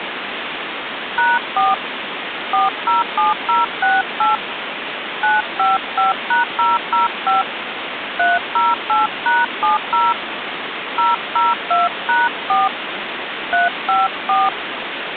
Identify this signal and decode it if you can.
DTMF, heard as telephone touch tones, dialled by hand, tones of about 170 ms, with phone line noise. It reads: #4 407068 955#005 308#70 002#4 354